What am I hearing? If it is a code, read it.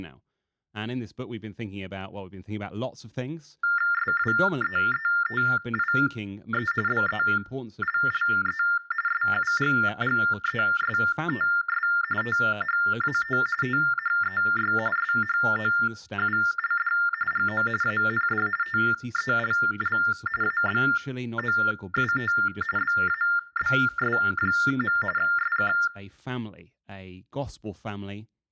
TTY/TDD text telephone tones (45.45 baud Baudot), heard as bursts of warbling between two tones, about 400 Hz shift, 1600 Hz centre, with room echo and speech in English. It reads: SWEETIE BELLE SUGGESTS THAT THEY SHOULD GO AND TELL ABOUT BABS. SK